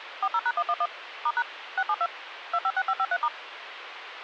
DTMF, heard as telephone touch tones, dialled by machine, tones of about 50 ms, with radio hiss. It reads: 40#111 *# 672 256553*